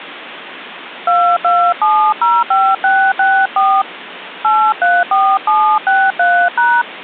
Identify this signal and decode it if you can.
DTMF, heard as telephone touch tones, dialled by hand, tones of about 260 ms, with phone line noise. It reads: 22705664 834763#